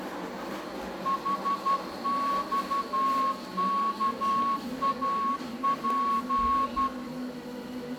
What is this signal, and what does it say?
Morse code, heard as a whistle, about 12 wpm, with room echo and the noise of a cafe. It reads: HXKAP